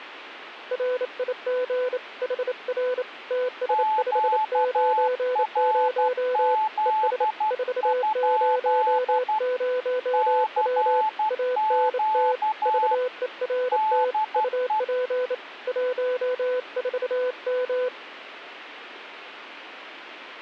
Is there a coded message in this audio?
Yes: Morse code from 0.7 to 17.9 s, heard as two keyed tones, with radio static. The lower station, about 28 wpm, 500 Hz: RIG HR TS590 ES 400W ANT VERT UP 14M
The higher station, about 12 wpm, 870 Hz: QRZ? CQ DE